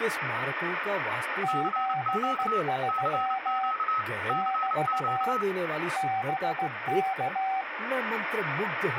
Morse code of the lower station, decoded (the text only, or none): 73 <BT> BK